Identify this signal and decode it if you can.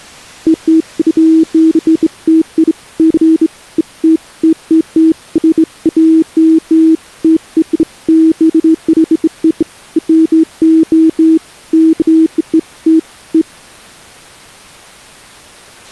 Beeps of irregular length. There is no code.